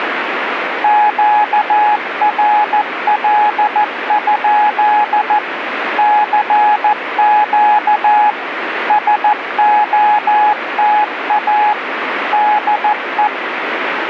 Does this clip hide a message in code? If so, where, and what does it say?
Yes: Morse code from 0.8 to 13.3 s, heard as a keyed tone, machine-sent, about 14 wpm, 840 Hz, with radio static. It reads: QRL? CQ SOTA DE